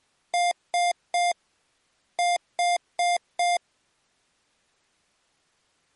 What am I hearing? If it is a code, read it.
Beep code, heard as beeps from a small speaker, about 700 Hz. 3-4.